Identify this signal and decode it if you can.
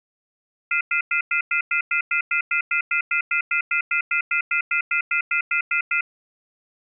Telephone call progress tone (North American plan), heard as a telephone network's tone, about 1400, 2050, 2450, 2600 Hz, 0.1 s on and 0.1 s off. Off-hook warning tone.